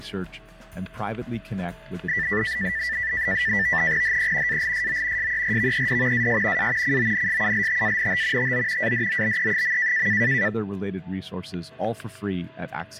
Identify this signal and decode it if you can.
NAVTEX (SITOR-B), 100 baud, 170 Hz shift, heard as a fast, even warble, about 1850 Hz centre, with static crashes and a steady whistle near 650 Hz. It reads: HE ALSO SERVED AS A CONSULTANT TO ADOBE.